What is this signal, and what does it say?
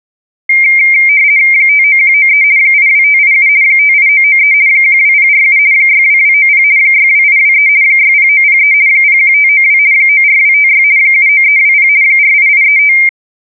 RTTY (50 baud, 170 Hz shift), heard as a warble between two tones, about 2200 Hz centre. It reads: 59193 82587 58993 12047 62290 62823 60903 01592 94256 79320 48835